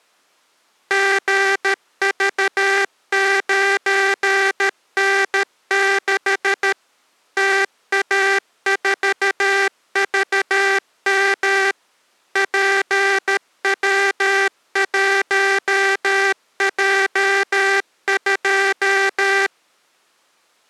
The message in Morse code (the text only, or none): GV9N6 TA4VM PW1J2